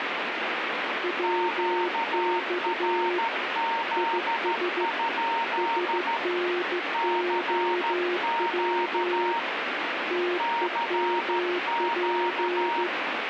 Morse code, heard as two keyed tones, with radio static. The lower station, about 15 wpm, 360 Hz: WX IS SNOW TEMP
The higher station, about 13 wpm, 920 Hz: QRZ? CQ CQ